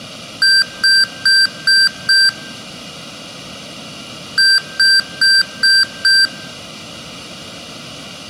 Beep code, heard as beeps from a small speaker, played twice, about 1550 Hz, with room echo. 5 short. In AMI BIOS tables: processor failure; in Dell tables: CMOS battery failure.